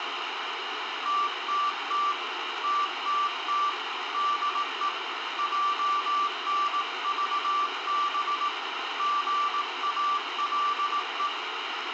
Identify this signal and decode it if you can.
Morse code, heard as a keyed tone, hand-sent with a paddle, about 18 wpm, 1170 Hz, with radio static and room echo. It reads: TTT TTT DE JNVB GALE